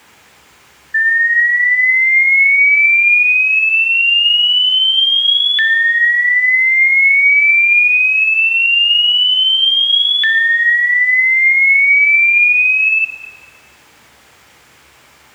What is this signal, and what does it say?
A tone that sweeps in pitch again and again, with room echo. There is no code.